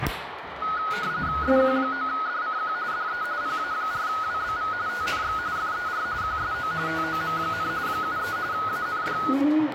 RTTY (45.45 baud, 170 Hz shift), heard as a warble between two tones, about 1360 Hz centre, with radio static and the noise of a restroom. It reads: SQ9DCQ DE PA4WBV TNX FER QSO TOM, 73 AND